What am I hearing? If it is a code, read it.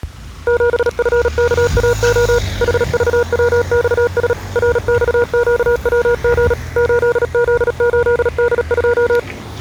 Morse code, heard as a keyed tone, machine-sent, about 37 wpm, 480 Hz, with the noise of a residential street. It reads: 7FKAO HVWXS RXQWG 8Z8D2